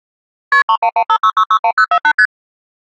Multi-frequency trunk signalling (R1, as on North American trunks), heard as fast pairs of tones, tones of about 70 ms. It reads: KP 31156661048 ST